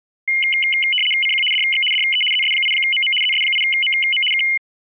RTTY (75 baud, 850 Hz shift), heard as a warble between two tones, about 2550 Hz centre. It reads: CQ DX DE ZS8MM ZS8MM K